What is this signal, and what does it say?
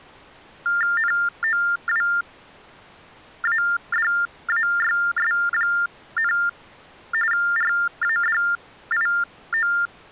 TTY/TDD text telephone tones (45.45 baud Baudot), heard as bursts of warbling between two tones, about 400 Hz shift, 1600 Hz centre. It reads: NOWADAYS, RADIO